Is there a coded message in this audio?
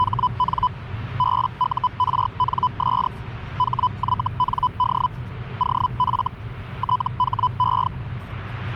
Yes: Hellschreiber (Feld-Hell, 122.5 baud) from 0.0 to 7.9 s, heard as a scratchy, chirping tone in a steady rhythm, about 1000 Hz, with the noise inside a car. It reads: … BURNS HYND OF THE